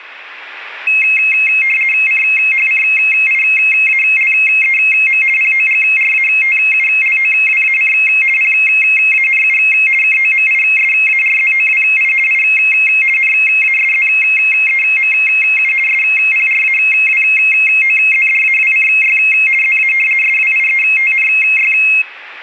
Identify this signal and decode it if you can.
RTTY (50 baud, 450 Hz shift), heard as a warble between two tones, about 2350 Hz centre. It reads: CHCIALEM POGRATULOWAC PANU KOMISARZOWI I NASZEMU SPRAWOZDAWCY ZA SWIETNY